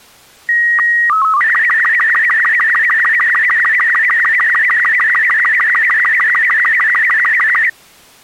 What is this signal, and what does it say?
SSTV (slow-scan television), Robot 36, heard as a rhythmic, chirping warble.